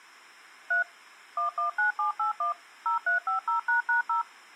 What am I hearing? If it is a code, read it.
DTMF, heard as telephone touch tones, dialled by machine, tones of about 120 ms. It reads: 3 119781 0350##0